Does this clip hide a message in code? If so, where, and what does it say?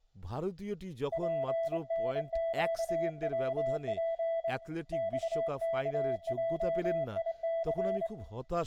Yes: Morse code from 1.1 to 8.1 s, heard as a keyed tone, hand-sent with a straight key, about 24 wpm, 660 Hz, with room echo and speech in Bangla. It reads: PNQWP XKJIC